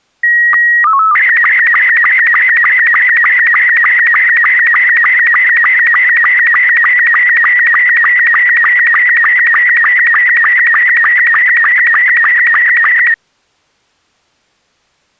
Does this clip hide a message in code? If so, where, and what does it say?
Yes: SSTV (slow-scan television), Robot 72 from 0.2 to 13.1 s, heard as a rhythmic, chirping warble.